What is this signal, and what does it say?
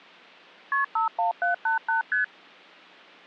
Multi-frequency trunk signalling (R1, as on North American trunks), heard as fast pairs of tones, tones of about 130 ms. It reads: KP 51788 ST